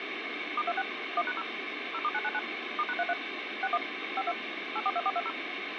DTMF, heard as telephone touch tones, dialled by machine, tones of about 50 ms, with phone line noise. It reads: *26 1#0 0*999 *#33 61 52 842420